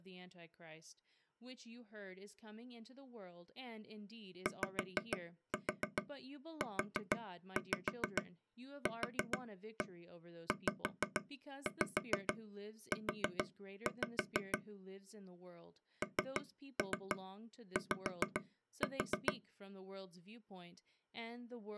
Tap code, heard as taps on a table, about 6 knocks a second, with speech in English. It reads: YUQZU NY